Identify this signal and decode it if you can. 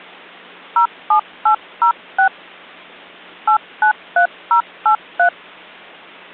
DTMF, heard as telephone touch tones, dialled by hand, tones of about 100 ms. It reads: 07806 893083